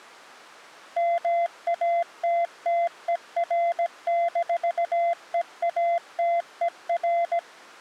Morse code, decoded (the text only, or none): MATTER-EATER